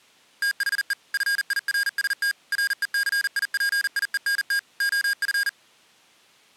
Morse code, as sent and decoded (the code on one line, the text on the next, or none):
- .... . / ..-. .. .-. ... - / .-. . -.-. .. .--. .. . -. - / --- ..-.
THE FIRST RECIPIENT OF